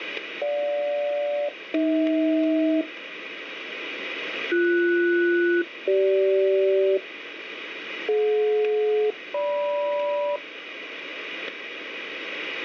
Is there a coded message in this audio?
Yes: aircraft SELCAL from 0.4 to 10.4 s, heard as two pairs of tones, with radio static and static crashes. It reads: GJ-AH BS-CG DJ-GM